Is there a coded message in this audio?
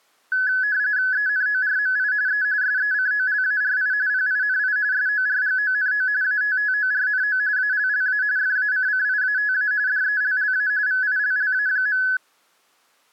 Yes: RTTY (45.45 baud, 170 Hz shift) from 0.3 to 12.2 s, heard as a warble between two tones, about 1600 Hz centre. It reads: ENORMI E SECOLARI PINI SORGONO ATTORNO ALLA FACCIATA DELLA VILLA.